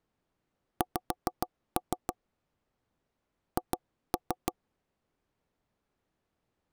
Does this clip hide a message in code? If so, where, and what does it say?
Yes: tap code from 0.8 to 4.5 s, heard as knocks on wood, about 6 knocks a second. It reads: X H